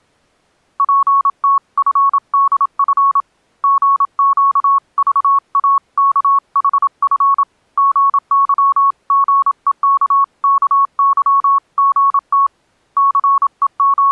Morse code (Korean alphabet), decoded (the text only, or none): 저는 새로운 세상에서 …